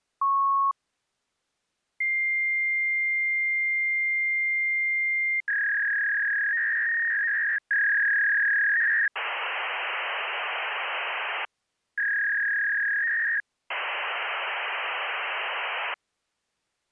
Fax machine handshake, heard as a beep, a long tone, a warble and hiss.